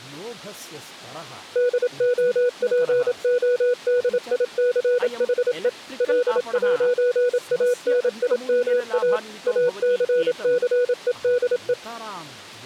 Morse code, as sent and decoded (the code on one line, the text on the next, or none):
-.. --- .--. --- -.. .. -.-. .... . / .-.. .----. .- -. .. -- .- / .- -.-. -.-. . -.. .
DOPODICHE L'ANIMA ACCEDE